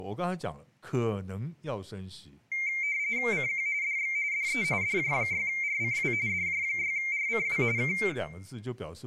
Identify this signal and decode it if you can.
RTTY (45.45 baud, 170 Hz shift), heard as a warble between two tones, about 2200 Hz centre, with room echo and speech in Chinese. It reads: CQ DX DE DJ6RCW DJ6RCW K